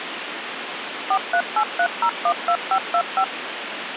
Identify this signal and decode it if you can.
DTMF, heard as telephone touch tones, dialled by machine, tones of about 70 ms, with phone line noise. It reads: 4383012525